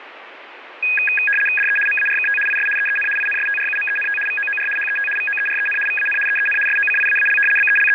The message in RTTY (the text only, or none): DE MARKT IS EEN INSTRUMENT VOOR HET VOEREN VAN EEN SOCIAAL …